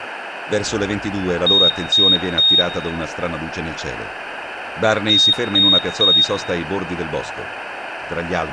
Beep code, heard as a piezo beeper, played twice, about 3700 Hz, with room echo and speech in Italian. 3 short. In AMI BIOS tables: failure in the first 64 KB of memory; in Dell tables: chipset error.